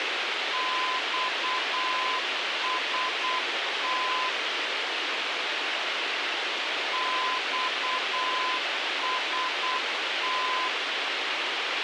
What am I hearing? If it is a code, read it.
Morse code, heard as a keyed tone, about 8 wpm, 1020 Hz, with radio hiss. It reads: XST XST